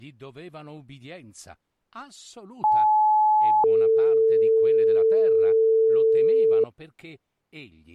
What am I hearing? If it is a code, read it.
Two-tone page, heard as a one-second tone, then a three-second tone, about 860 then 450 Hz.